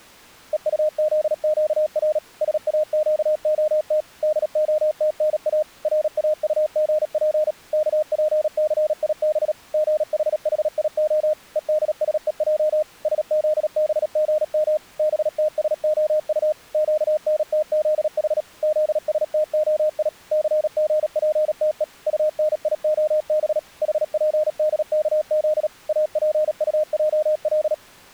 Morse code (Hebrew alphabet), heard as a keyed tone, machine-sent, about 37 wpm, 610 Hz. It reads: וטזקר שאקהת דהתנא ראטגף כפסיב גחחיה ודשוע שזבגם בתשהט קנתזח זשתהי סגפתו טניהב חפדכז אפטעל